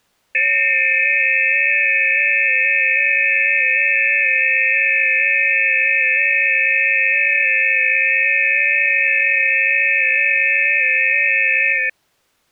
FT8 (several signals at once), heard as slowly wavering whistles, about 6.25 baud.